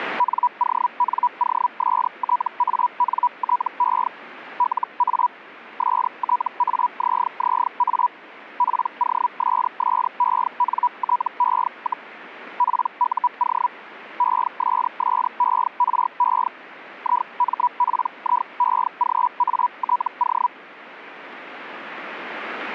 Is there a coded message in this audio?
Yes: Hellschreiber (Feld-Hell, 122.5 baud) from 0.2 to 20.5 s, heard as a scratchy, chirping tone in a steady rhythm, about 980 Hz. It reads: NONOSTANTE LA STAZZA POSSENTE, PUO ESSERE IMPIEGATO